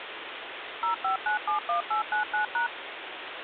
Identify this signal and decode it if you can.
DTMF, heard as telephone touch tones, dialled by machine, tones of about 120 ms, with phone line noise. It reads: 05971899#